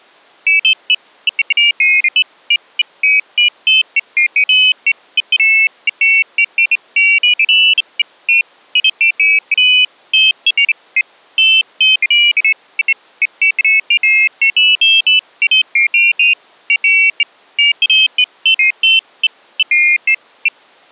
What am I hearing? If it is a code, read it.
Pairs of high tones at irregular times. There is no code.